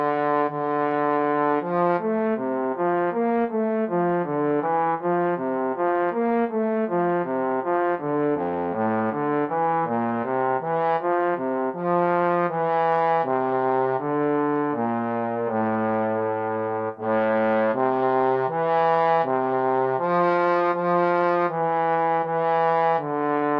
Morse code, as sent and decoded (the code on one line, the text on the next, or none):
none